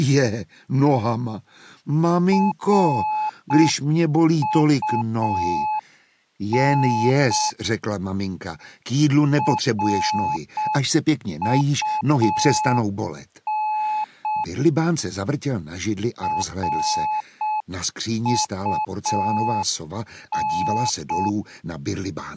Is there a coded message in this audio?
Yes: Morse code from 2.3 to 21.4 s, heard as a keyed tone, hand-sent with a paddle, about 6 wpm, 860 Hz. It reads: RUN RUN RUN